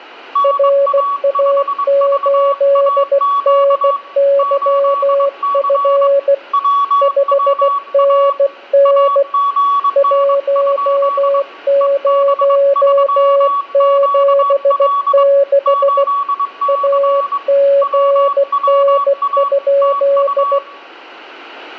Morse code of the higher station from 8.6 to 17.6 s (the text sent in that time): AGN? EB3QL 8C